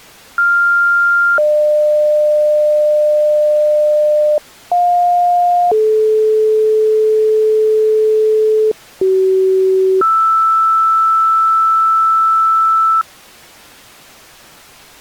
Two-tone page, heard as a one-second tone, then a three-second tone, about 1400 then 600 Hz, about 710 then 430 Hz, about 380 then 1320 Hz.